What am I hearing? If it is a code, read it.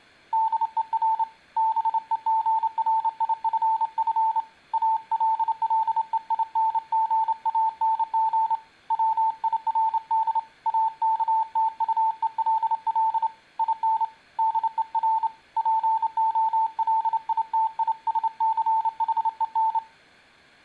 Morse code, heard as a keyed tone, hand-sent with a straight key, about 28 wpm, 890 Hz. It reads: DER BEGRIFF ALLEINGANG WIRD AKTUELL IN DER POLITISCHEN